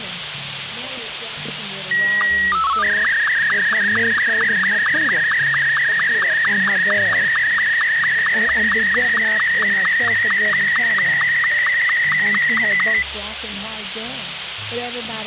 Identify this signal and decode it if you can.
SSTV (slow-scan television), Martin M2, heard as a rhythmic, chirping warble, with radio hiss.